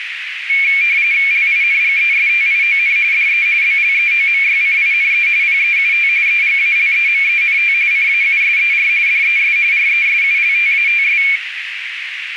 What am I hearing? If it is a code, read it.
RTTY (45.45 baud, 170 Hz shift), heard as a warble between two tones, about 2300 Hz centre, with radio static and a narrow filter. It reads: LINGESTION DE BLEOMYCINE PEUT EGALEMENT CAUSER DES RESULTATS